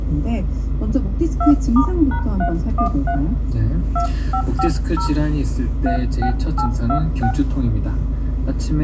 DTMF, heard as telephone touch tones, dialled by hand, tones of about 90 ms, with room echo and the noise inside a car. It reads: 2*#313 2550 36826